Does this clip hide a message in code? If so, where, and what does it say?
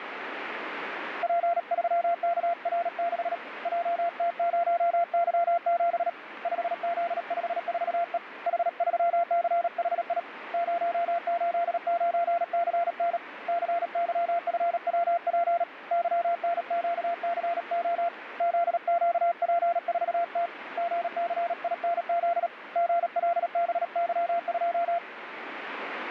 Yes: Morse code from 1.2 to 25.0 s, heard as a keyed tone, hand-sent with a paddle, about 37 wpm, 690 Hz, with radio static. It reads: P3KR6 JT0Y7 5Z54E H3CHI 089CN CYFWP YNQCO ZQP4T GCINZ GLBY2